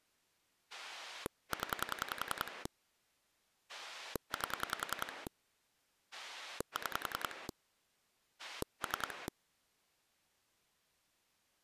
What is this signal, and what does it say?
Pulse dialling, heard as a rotary dial, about 10 pulses a second. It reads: 0 8 6 3